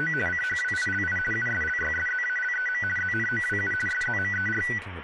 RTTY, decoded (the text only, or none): … CHWILI USLYSZALEM ZNOWU SZMER